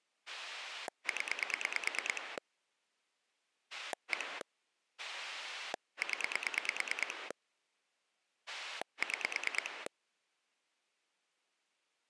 Pulse dialling, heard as a rotary dial, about 9 pulses a second. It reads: 0 1 0 6